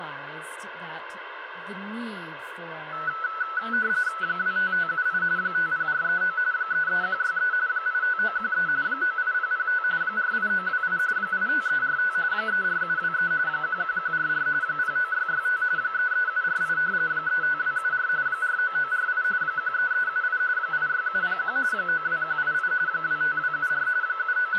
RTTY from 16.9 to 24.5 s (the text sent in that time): 35274 49948 13378 86701 92188 25274 …